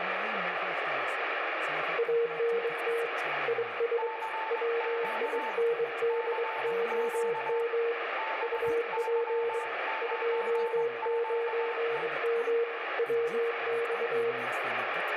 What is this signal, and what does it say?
Morse code, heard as two keyed tones, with radio static, room echo and speech in Arabic. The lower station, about 23 wpm, 470 Hz: ANT IS WINDOM UP 29M WX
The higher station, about 20 wpm, 880 Hz: CQ CQ BY9QE